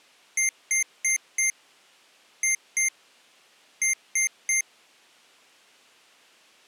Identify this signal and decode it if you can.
Beep code, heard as beeps from a small speaker, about 2100 Hz. 4-2-3. In Phoenix BIOS tables: gate A20 failure.